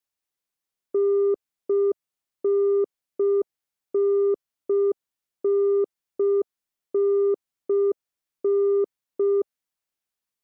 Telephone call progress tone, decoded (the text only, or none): congestion tone